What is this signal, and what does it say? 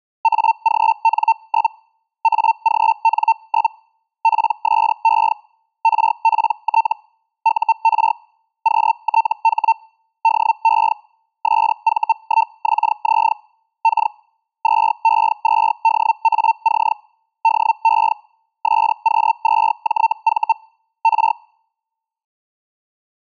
Hellschreiber (Feld-Hell, 122.5 baud), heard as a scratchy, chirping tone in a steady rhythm, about 900 Hz. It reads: AGN? AGN? PSE RPT UR QTH DE SV1XZ K 2E2DAC DE SQ2JV R